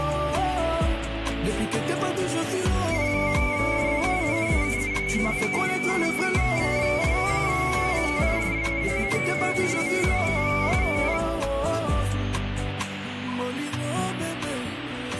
Multi-tone FSK (Olivia or MFSK type), about 250 Hz wide, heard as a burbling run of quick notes, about 31.25 baud, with radio static.